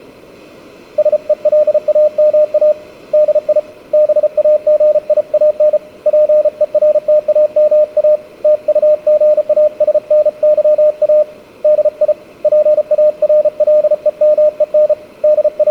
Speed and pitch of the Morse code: 34 wpm, 610 Hz

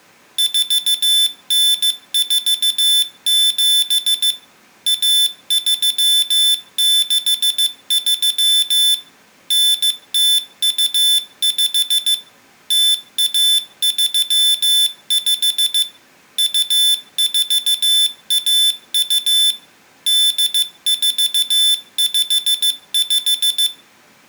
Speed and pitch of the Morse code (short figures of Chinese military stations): 15 wpm, 3500 Hz

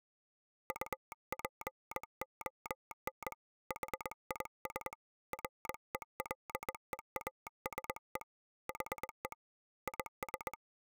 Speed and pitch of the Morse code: 21 wpm

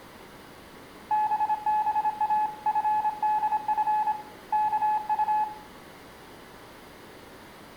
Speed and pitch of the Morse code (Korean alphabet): 26 wpm, 850 Hz

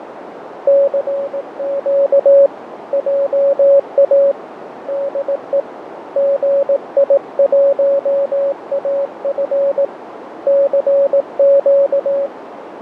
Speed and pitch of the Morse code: 18 wpm, 560 Hz

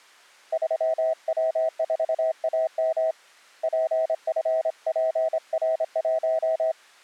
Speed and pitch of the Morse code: 26 wpm, 640 Hz

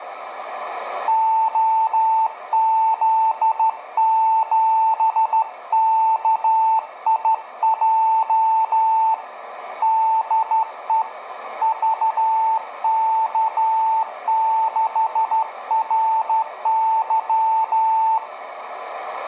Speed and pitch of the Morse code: 13 wpm, 890 Hz

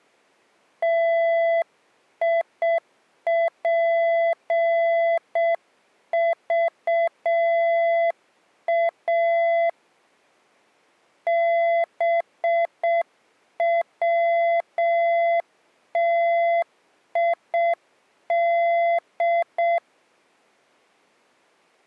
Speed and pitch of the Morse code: 6 wpm, 680 Hz

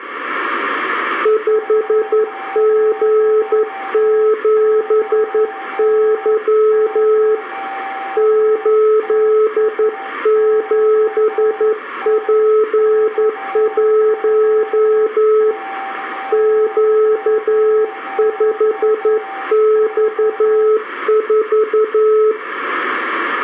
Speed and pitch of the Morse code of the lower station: 11 wpm, 430 Hz

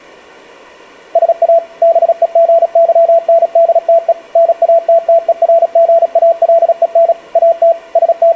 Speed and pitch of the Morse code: 36 wpm, 670 Hz

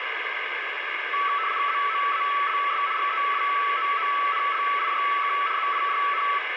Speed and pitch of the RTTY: 75 baud, 170 Hz shift, 1220 Hz centre

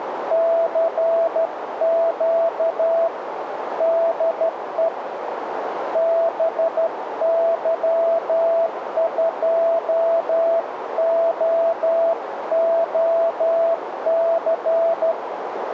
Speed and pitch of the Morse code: 12 wpm, 660 Hz

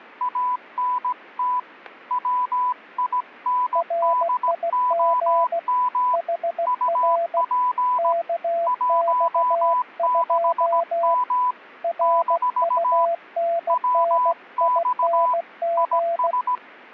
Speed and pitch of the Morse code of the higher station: 17 wpm, 1000 Hz

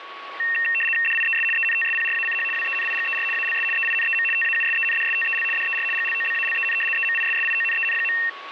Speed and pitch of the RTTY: 75 baud, 850 Hz shift, 2300 Hz centre

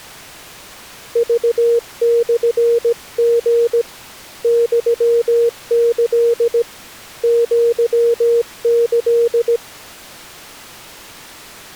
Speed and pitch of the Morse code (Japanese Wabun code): 17 wpm, 470 Hz

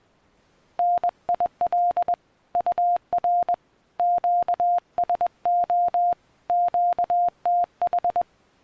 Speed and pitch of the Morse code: 21 wpm, 700 Hz

